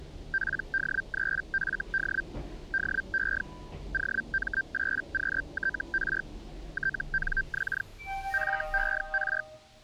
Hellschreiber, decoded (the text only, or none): PD3FD DE OM8QTR TNX FER